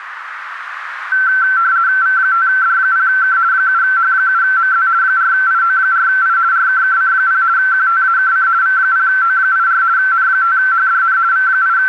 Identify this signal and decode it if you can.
RTTY (50 baud, 170 Hz shift), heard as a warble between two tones, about 1440 Hz centre, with radio static and a narrow filter. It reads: V5D0K 7H7MZ 4IO4I RKKC0 QTAKC V0O84 N5HDN …